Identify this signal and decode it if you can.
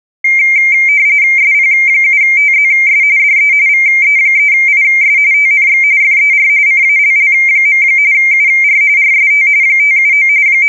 RTTY (45.45 baud, 170 Hz shift), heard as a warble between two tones, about 2200 Hz centre. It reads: SP7TZS DE VE3IS TNX FER CALL. UR RST 579 …